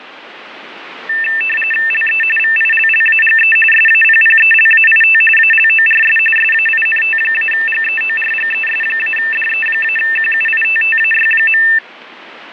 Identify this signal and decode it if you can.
RTTY (45.45 baud, 850 Hz shift), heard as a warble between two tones, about 2200 Hz centre, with radio static. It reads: LE VILLAGE SAPPELAIT ALORS SAINT-GEORGES-DE-QUITTAY.